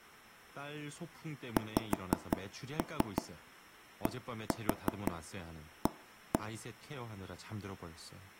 Tap code, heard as taps on a table, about 5 knocks a second, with speech in Korean. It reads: XDA